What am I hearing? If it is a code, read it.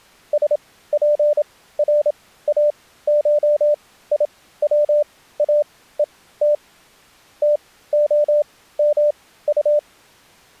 Morse code (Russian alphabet), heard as a keyed tone, machine-sent, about 27 wpm, spaced as for 16 wpm, 590 Hz. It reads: СПРАШИВАЕТ ТОМУ